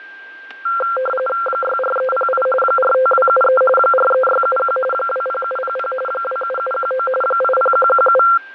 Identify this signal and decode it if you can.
RTTY (45.45 baud, 850 Hz shift), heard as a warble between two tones, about 940 Hz centre, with fading, static crashes and a steady whistle near 1580 Hz. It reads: 64308 45273 43671 20700 27719 80117